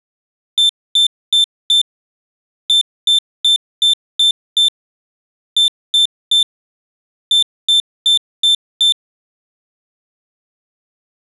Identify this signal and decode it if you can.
Beep code, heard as a piezo beeper, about 3550 Hz. 4-6-3-5.